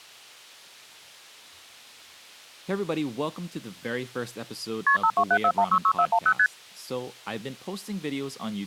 Multi-frequency trunk signalling (R1, as on North American trunks), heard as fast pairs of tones, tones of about 70 ms, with speech in English. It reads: KP 5274166410 ST